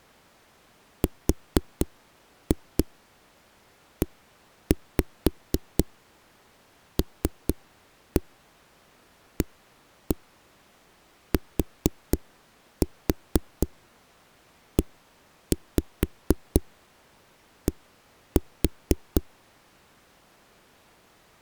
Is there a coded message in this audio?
Yes: tap code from 1.0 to 19.2 s, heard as knocks on a wall, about 4 knocks a second. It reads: RELATED